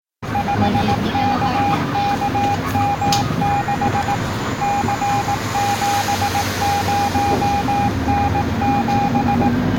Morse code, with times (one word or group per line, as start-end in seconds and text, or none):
0.3-4.1 5KKM6
4.6-9.5 C70N7